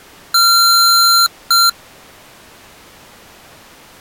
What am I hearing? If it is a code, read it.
Beep code, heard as beeps from a small speaker, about 1370 Hz. 1 long, 1 short. In IBM BIOS tables: system board problem.